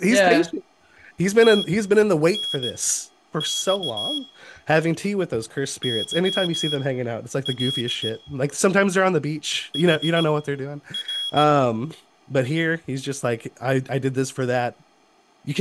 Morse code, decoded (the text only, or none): TNX YL HR